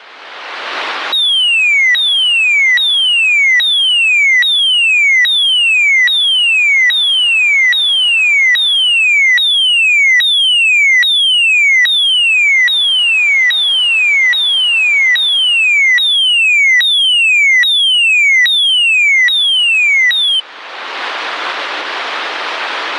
A tone that sweeps in pitch again and again. There is no code.